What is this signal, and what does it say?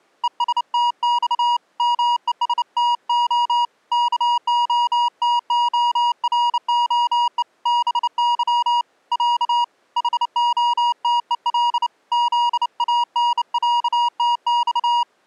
Morse code (Russian alphabet), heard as a keyed tone, hand-sent with a bug key, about 29 wpm, 960 Hz. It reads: ЕСТЬ МЕСТО КОТОРОЕ БЫ Я ХОТЕЛ ЗАНЯТЬ